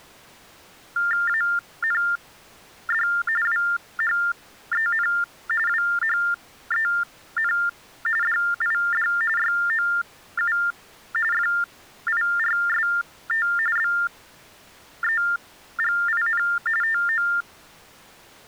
TTY/TDD text telephone tones (45.45 baud Baudot), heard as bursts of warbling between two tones, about 400 Hz shift, 1600 Hz centre. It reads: AND WHEN WHEN DID YOU FIRST BEGIN TO